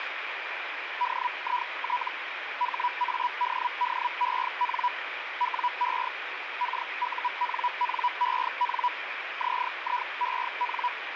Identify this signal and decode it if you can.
Hellschreiber (Feld-Hell, 122.5 baud), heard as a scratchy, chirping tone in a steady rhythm, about 980 Hz, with radio static. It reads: DIT HADDEN WE KUNNEN ZIEN